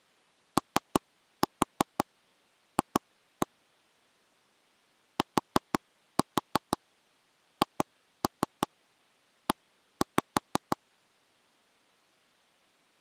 Tap code, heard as taps on a table, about 5 knocks a second. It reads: OF THE